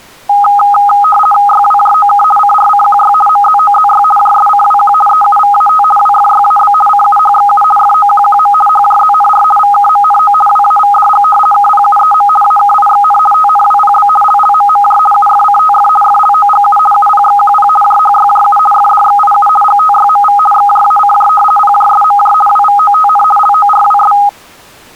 RTTY (50 baud, 450 Hz shift), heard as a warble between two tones, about 1040 Hz centre. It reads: YWJOK CRCQY MZOZY JSCWQ EUVAT WFYAB CUHXU FOQQM HJZNR VKMNO WAVDG KPUEM AKIXN TNWPB LLMMJ UFCTF FLOGU UPXQP JHYJU FDXIU GTYMV XJACJ PJSMJ WVOTN LORWS